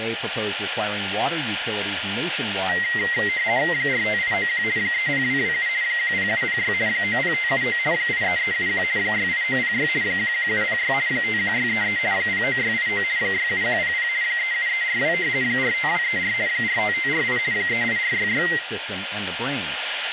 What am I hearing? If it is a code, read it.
RTTY (50 baud, 170 Hz shift), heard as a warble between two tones, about 2000 Hz centre, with radio static, a steady whistle near 1410 Hz, room echo and speech in English. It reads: 45891 30227 10706 90579 83371 68906 11706 51633 09689 67100 37342 45234 45548 38466